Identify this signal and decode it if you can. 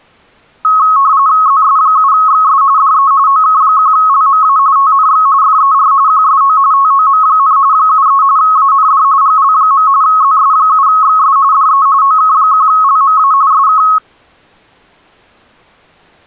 RTTY (45.45 baud, 170 Hz shift), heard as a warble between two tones, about 1190 Hz centre. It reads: ZS7XS DE OK1LMA TNX FER QSO TOM, 73 AND GL. ZS7XS DE OK1LMA SK